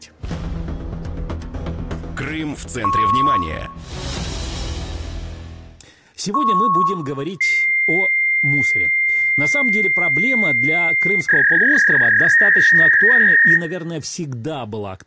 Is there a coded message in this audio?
Yes: fax machine handshake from 2.8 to 13.6 s, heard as beeps, a long tone and a warble, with room echo.